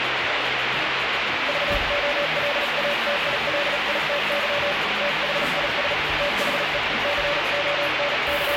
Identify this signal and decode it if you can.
Morse code, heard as a keyed tone, hand-sent with a paddle, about 37 wpm, 580 Hz, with heavy radio static and the noise of a cafe. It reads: VOLATILITY THIS THE …